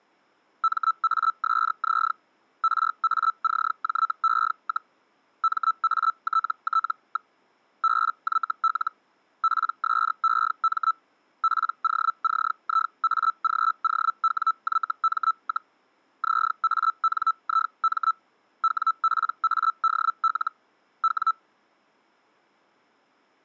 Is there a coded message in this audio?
Yes: Hellschreiber (Feld-Hell, 122.5 baud) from 0.6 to 21.3 s, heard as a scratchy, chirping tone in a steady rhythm, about 1320 Hz. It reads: MASZ RACJE, MATT. BYL PSEM POCIAGOWYM, ZANIM WPADL W